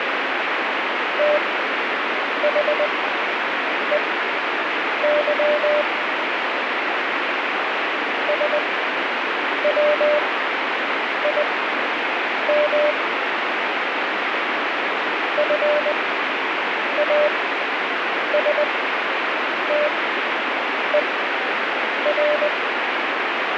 Morse code, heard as a keyed tone, machine-sent, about 20 wpm, spaced as for 7 wpm, 600 Hz, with heavy radio static. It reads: THEY SWIM FASTER